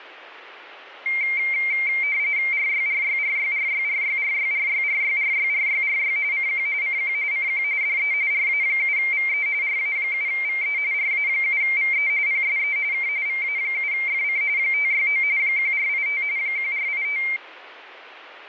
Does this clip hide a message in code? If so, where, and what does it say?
Yes: RTTY (45.45 baud, 170 Hz shift) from 1.1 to 17.4 s, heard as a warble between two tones, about 2200 Hz centre. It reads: RYRYRYRYRYRYRYRYRYRYRY CQ CQ CQ DE RA7VE RA7VE RA7VE PSE K VA7FC 569 1485 1485